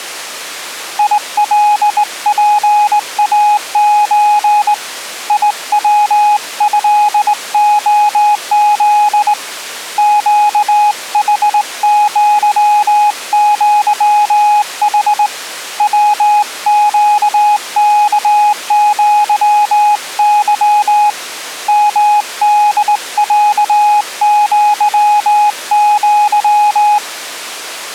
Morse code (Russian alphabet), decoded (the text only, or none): ИЛПАЧ ИВЭОЗ ЩХЪЪХ ВЩКЪЫ МДЯЪЪ